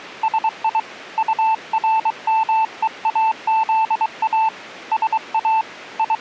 Morse code, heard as a keyed tone, hand-sent with a paddle, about 23 wpm, 880 Hz. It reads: SI URMEAZA SA …